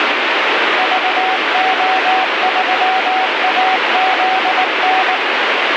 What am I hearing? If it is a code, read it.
Morse code, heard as a keyed tone, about 19 wpm, 760 Hz, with heavy radio static. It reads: VO3AZN